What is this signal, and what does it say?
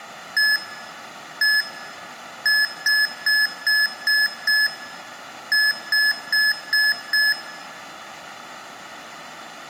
Beep code, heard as beeps from a small speaker, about 1700 Hz, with room echo. 1-1-6-5.